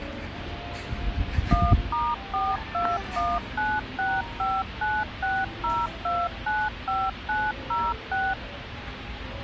DTMF, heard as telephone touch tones, dialled by machine, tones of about 220 ms, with phone line noise and the noise of a park. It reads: 1*421965960295906